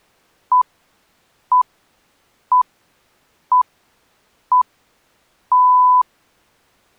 Radio time signal (six pips, as the Greenwich Time Signal), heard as pips.